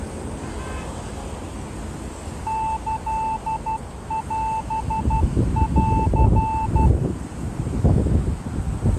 Morse code (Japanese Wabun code), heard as a keyed tone, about 12 wpm, 880 Hz, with street noise. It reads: キオン